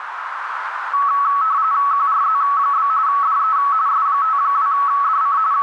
RTTY (45.45 baud, 170 Hz shift), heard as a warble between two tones, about 1210 Hz centre, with radio static and a narrow filter. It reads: QRZ? DE S52DC …